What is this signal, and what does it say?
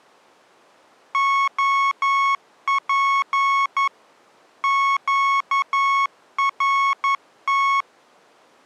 Morse code, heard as electronic beeps, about 11 wpm, 1100 Hz. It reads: OP QRT